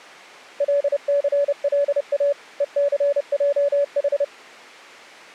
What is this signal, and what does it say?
Morse code, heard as a keyed tone, machine-sent, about 30 wpm, 570 Hz. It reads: LCLA ECJH